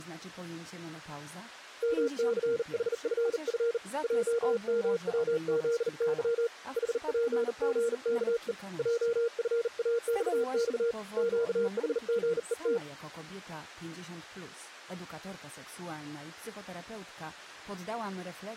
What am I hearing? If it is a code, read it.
Morse code, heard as a keyed tone, hand-sent with a bug key, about 39 wpm, 470 Hz. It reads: MCHFF JMWZY HPGKE JFAXX QHGET